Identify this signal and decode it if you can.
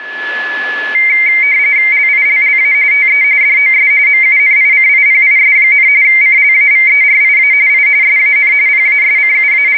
RTTY (45.45 baud, 170 Hz shift), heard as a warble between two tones, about 2200 Hz centre, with a steady whistle near 1710 Hz. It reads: LILLA TE DOS MUNICIPIS, CLAVERIA I SAN …